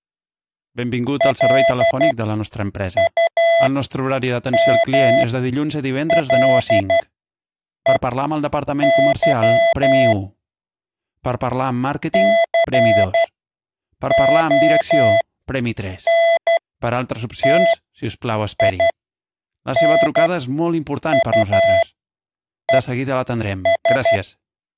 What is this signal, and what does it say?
Morse code, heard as electronic beeps, machine-sent, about 12 wpm, spaced as for 7 wpm, 670 Hz. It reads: LUMLEY CONTINUES